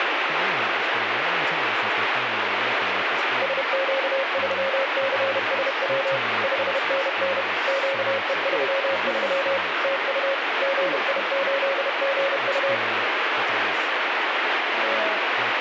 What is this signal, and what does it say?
Morse code, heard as a keyed tone, machine-sent, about 31 wpm, 540 Hz, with radio static and speech in English. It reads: SQ3CSW 5NN QE33 TU GI8GU